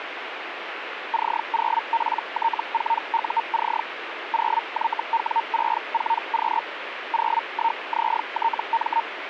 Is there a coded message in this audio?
Yes: Hellschreiber (Feld-Hell, 122.5 baud) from 1.1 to 9.0 s, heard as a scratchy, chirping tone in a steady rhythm, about 920 Hz, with radio static. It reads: C0PT4UC 0YW64Q 01ZTM